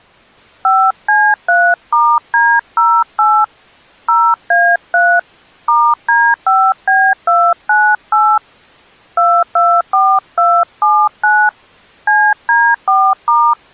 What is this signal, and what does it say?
DTMF, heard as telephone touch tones, dialled by hand, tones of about 260 ms. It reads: 5C3*D08 0A3 *D5B298 224279 CD4*